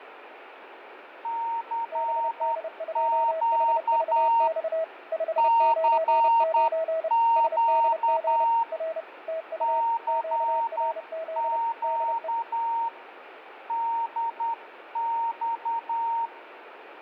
Morse code, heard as two keyed tones, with radio static, fading and room echo. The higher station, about 10 wpm, 920 Hz: CQ CQ CQ DX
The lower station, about 30 wpm, 650 Hz: BD2HVX 599 SDG R TU QRZ DE